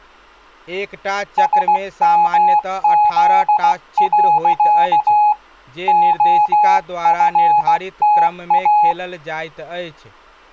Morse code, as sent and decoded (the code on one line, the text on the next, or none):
... -- --.. .-.-.- / --- ..-. - .-
SMZ. OFTA